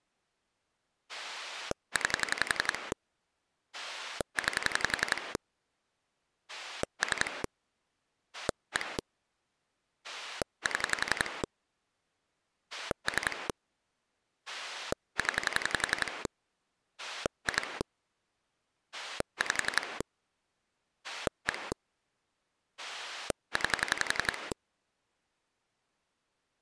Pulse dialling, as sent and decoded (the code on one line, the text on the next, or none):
9 / 9 / 3 / 1 / 7 / 3 / 10 / 2 / 5 / 1 / 9
9 9 3 1 7 3 0 2 5 1 9